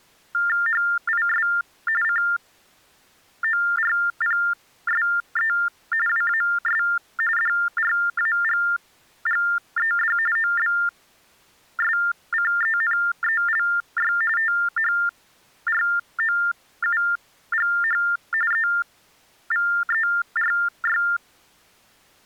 TTY/TDD text telephone tones (45.45 baud Baudot), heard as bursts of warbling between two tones, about 400 Hz shift, 1600 Hz centre. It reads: HIS CORPSE WAS DRAGGED OBSCENELY THROUGH EVERY